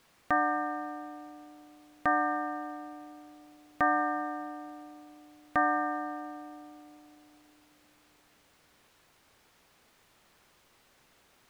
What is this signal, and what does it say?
Clock strike, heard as a bell. 4. Four o'clock.